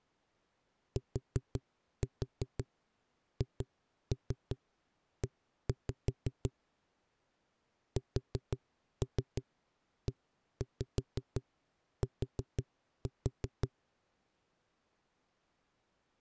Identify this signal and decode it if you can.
Tap code, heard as knocks on a wall, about 5 knocks a second. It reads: THE SET